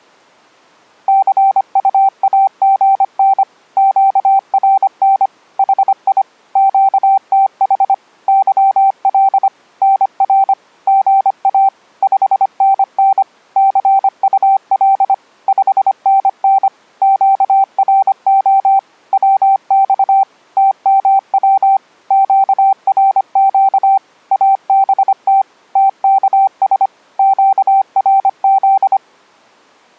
Morse code, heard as a keyed tone, machine-sent, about 25 wpm, 780 Hz. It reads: CUAGN QRN HI QTH YL NR GA 5NN CUL 5NN QRO WX TMW QRQ ABT TKS QRZ